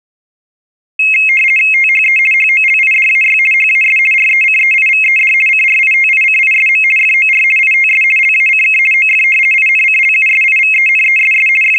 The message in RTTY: THE HOLIDAY HAS RECEIVED CRITICISM FOR ITS LACK OF INCLUSIVENESS …

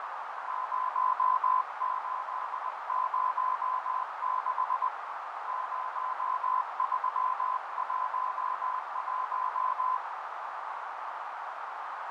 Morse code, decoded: 0806 0311

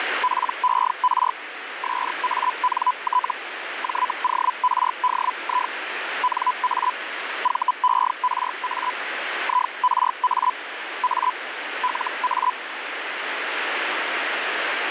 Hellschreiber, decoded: PER SANT JORDI NA VERA IRA A LA

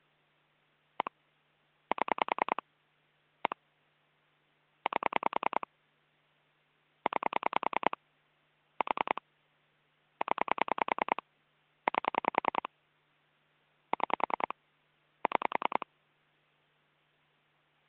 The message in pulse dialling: 1 7 1 8 9 4 0 8 6 6

